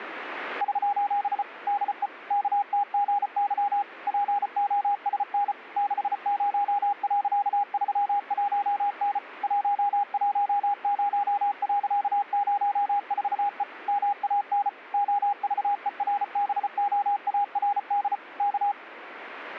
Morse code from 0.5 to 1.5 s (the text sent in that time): <SOS>